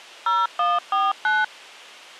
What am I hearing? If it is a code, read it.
DTMF, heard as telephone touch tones, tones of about 200 ms. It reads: 0149